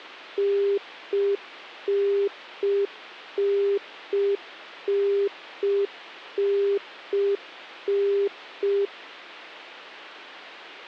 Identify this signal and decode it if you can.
Telephone call progress tone (UK plan), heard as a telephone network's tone, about 400 Hz. Congestion tone.